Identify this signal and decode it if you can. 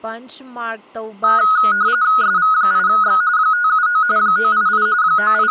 RTTY (45.45 baud, 170 Hz shift), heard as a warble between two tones, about 1360 Hz centre, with speech in Manipuri. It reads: SV8X 579 988 …